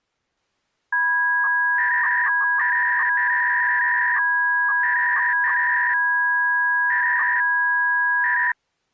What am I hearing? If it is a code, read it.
300-baud modem data (V.21 tones), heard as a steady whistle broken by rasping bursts, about 300 baud, 200 Hz shift.